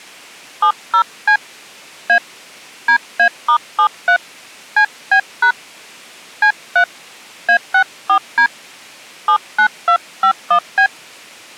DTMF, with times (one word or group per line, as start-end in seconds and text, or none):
0.6-1.4 70C
2.1-2.2 A
2.9-4.2 DA*73
4.8-5.5 CB#
6.4-6.8 C3
7.5-8.5 A64D
9.3-10.9 79251B